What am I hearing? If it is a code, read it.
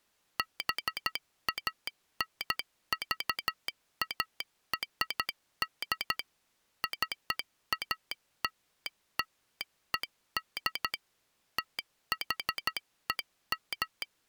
Morse code (American railroad code), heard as a telegraph sounder, machine-sent. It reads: BANVARD CALLED THEM